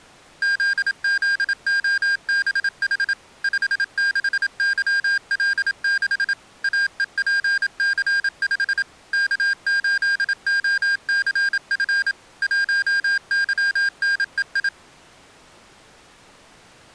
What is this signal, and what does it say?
Morse code, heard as electronic beeps, machine-sent, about 27 wpm, 1600 Hz. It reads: ZZOBH 56YL6 AEPC5 K8OCF 1YNEI